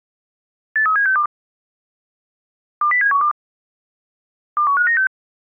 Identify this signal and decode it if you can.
Five-tone selective call (CCIR), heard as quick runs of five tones, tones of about 100 ms. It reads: 83762 20712 21596